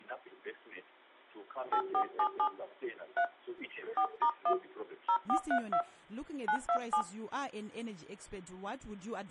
DTMF, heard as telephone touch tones, dialled by hand, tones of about 80 ms. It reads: 8477 3 4*1 0432 927